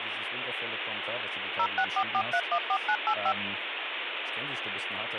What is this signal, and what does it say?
DTMF, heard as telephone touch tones, dialled by machine, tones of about 70 ms, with phone line noise and speech in German. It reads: 0644314985